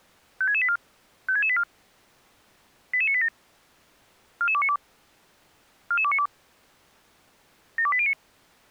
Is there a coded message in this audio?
Yes: five-tone selective call (ZVEI) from 0.4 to 8.1 s, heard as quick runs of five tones, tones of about 70 ms. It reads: 56684 56684 88987 44292 44292 72809